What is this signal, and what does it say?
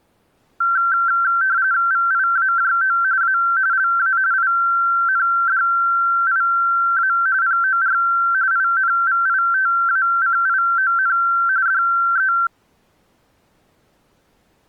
RTTY (45.45 baud, 170 Hz shift), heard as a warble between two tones, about 1460 Hz centre. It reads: VIAJO A LA INDIA POR INVITACION DE